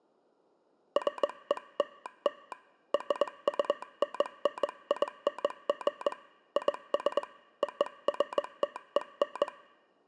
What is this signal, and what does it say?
Morse code (American railroad code), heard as a telegraph sounder, hand-sent with a straight key. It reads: FELL RUNNING IS OFTEN